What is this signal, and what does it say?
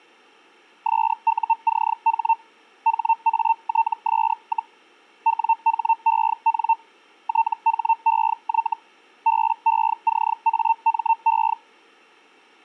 Hellschreiber (Feld-Hell, 122.5 baud), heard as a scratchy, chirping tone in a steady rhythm, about 900 Hz. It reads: SUCH HATS, WHEN THEY BECAME